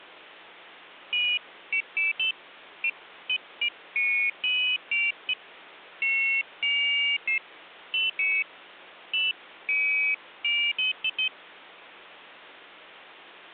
Pairs of high tones at irregular times. There is no code.